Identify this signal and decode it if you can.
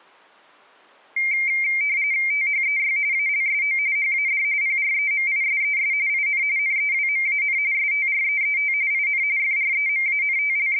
RTTY (45.45 baud, 170 Hz shift), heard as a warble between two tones, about 2200 Hz centre. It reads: THEY ALSO HAD PREMISES IN NEWMAN STREET IN …